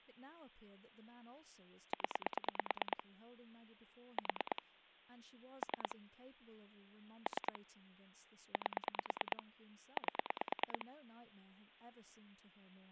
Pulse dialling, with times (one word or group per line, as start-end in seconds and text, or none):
1.9-3.0 0
4.2-4.6 4
5.6-6.0 3
7.3-7.6 3
8.5-9.4 8
10.0-10.9 8